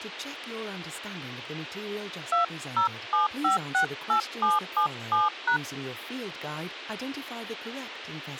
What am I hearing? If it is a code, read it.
DTMF, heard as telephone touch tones, dialled by hand, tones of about 130 ms. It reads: 207568777#